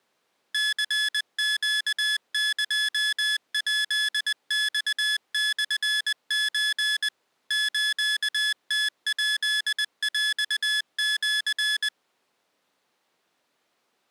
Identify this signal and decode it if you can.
Morse code (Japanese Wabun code), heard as electronic beeps, machine-sent, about 20 wpm, 1700 Hz. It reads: ニネエヱマモソ スムヱヰシ